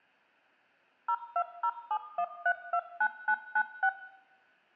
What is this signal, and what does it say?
DTMF, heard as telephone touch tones, dialled by machine, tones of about 70 ms, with room echo. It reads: 02071329996